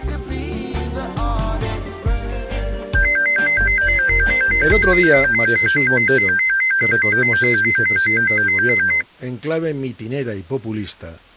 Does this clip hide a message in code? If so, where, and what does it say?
No, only a tone that alternates evenly between two pitches.